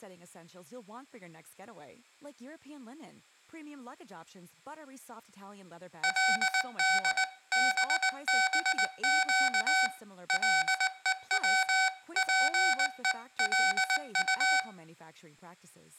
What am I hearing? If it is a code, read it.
Morse code (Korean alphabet), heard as electronic beeps, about 19 wpm, 760 Hz, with room echo and speech in English. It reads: 그때 갑자기